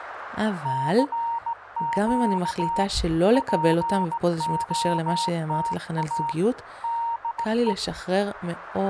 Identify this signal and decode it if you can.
Morse code, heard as a keyed tone, hand-sent with a straight key, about 17 wpm, 930 Hz, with radio static and speech in Hebrew. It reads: CQ POTA DE